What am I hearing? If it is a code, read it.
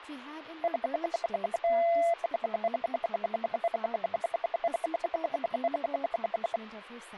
Radio time signal (RWM, Moscow), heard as ten pulses a second, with speech in English.